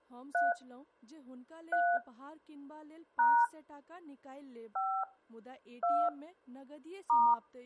DTMF, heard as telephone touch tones, dialled by hand, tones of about 280 ms, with speech in Maithili. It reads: 3 3 # 5 2 *